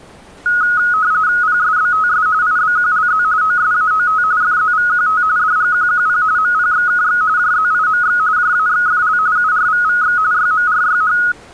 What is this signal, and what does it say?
RTTY (45.45 baud, 170 Hz shift), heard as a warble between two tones, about 1360 Hz centre. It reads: PSBTS IBQLZ OSAOT FZVQT DGQQP MPXKX JZIMX JAXFL URVVX YMRYH